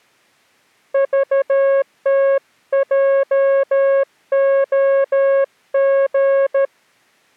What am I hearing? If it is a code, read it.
Morse code, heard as a keyed tone, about 13 wpm, 550 Hz. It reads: VTJOG